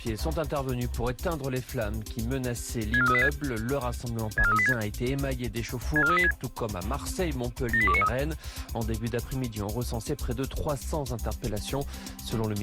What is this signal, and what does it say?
Five-tone selective call (ZVEI), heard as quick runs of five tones, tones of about 70 ms. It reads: 64386 64386 64386 78293